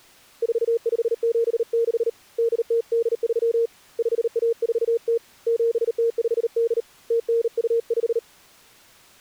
Morse code (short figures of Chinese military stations), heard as a keyed tone, hand-sent with a bug key, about 38 wpm, 460 Hz. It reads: 4576 8083 5140 7058 0925